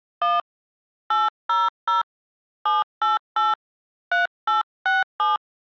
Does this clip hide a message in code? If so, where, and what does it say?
Yes: DTMF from 0.2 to 5.4 s, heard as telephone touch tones, dialled by hand, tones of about 170 ms. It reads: 1 800 788 3867